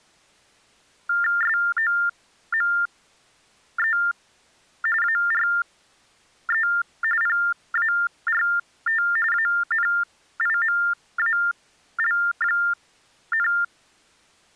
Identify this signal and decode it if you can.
TTY/TDD text telephone tones (45.45 baud Baudot), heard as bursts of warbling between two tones, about 400 Hz shift, 1600 Hz centre. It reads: SOME ARE PART ANIMAL,